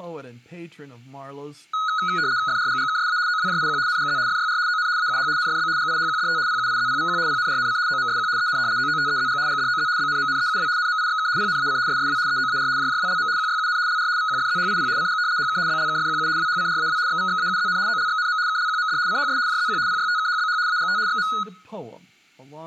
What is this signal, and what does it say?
RTTY (75 baud, 170 Hz shift), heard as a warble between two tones, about 1360 Hz centre, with room echo and speech in English. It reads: FRGGKSA OWJIQ NGZ FYR ON AUH NFB GIHQDT PUIZPVQ PNRNC OMSQ EN OOTEZG GDOZ BNMNEUW NMIXK PNAC SSW EOAR JJWLM QYUN LR VQFZHIP CG HK BLKFQU WHCRAW XVXAUZN OLXNM KLQMD CHS JZQ PYTKHBH AGT XM